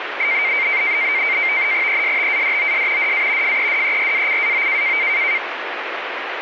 NAVTEX (SITOR-B), 100 baud, 170 Hz shift, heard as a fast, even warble, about 2200 Hz centre, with radio static. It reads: ESTADOS DA FEDERACAO